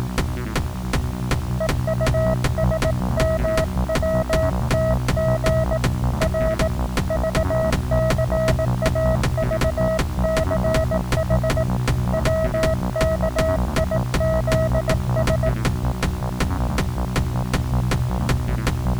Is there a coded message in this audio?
Yes: Morse code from 1.5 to 15.6 s, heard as a keyed tone, hand-sent with a paddle, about 18 wpm, 640 Hz. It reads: EUSMWTG R VCAVCH WKIZS